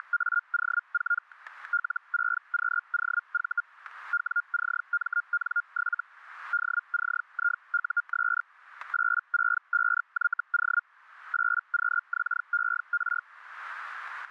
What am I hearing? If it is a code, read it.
Hellschreiber (Feld-Hell, 122.5 baud), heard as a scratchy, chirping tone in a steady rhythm, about 1410 Hz, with static crashes. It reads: … L6QOV WCMN7 DCIUS 865YO 8QXER